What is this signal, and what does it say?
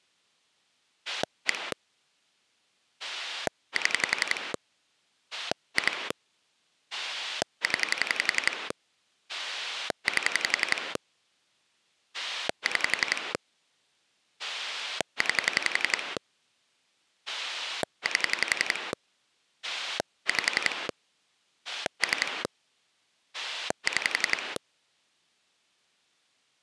Pulse dialling, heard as a rotary dial, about 11 pulses a second. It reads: 1 7 2 0 8 6 9 8 5 3 6